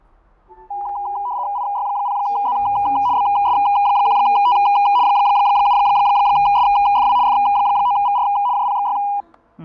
RTTY (75 baud, 170 Hz shift), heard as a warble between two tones, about 900 Hz centre, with fading, static crashes and the noise inside a lift. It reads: IY0Z BS1T 7SFW F9VR JPXY